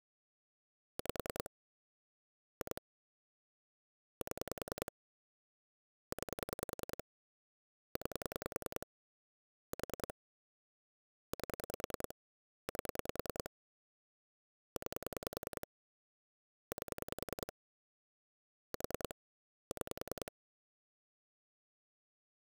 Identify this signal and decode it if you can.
Pulse dialling, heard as clicks on a phone line, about 10 pulses a second. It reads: 5 2 7 9 9 4 8 8 9 8 4 6